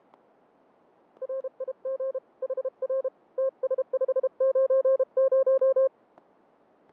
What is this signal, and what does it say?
Morse code, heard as a keyed tone, hand-sent with a paddle, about 32 wpm, 530 Hz, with fading and static crashes. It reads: RIG HR TS590